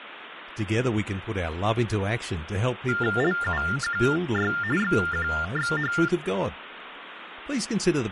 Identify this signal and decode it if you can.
TTY/TDD text telephone tones (45.45 baud Baudot), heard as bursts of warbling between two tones, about 400 Hz shift, 1600 Hz centre, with phone line noise and speech in English. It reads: LUQY XQXH